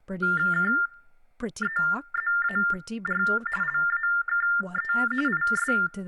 TTY/TDD text telephone tones (45.45 baud Baudot), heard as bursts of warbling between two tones, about 400 Hz shift, 1600 Hz centre, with room echo and speech in English. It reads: KEZAR LAKE IS